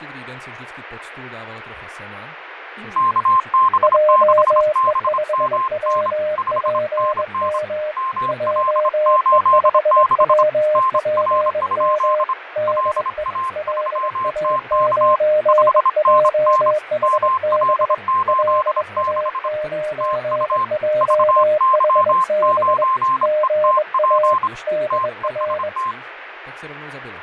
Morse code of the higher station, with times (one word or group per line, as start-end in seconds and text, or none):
3.0-6.1 KB6BMN
6.4-7.6 5NN
8.0-10.4 ML86
10.8-12.3 NR?
12.7-15.2 LA3TK
15.5-16.7 5NN
17.0-19.5 ML86
20.0-20.6 TU
21.0-24.5 VY9ETP
24.9-25.9 TEST